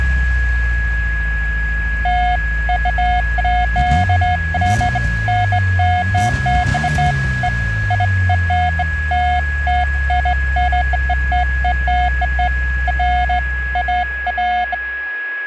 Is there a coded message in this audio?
No, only beeps of irregular length, with a steady whistle near 1670 Hz.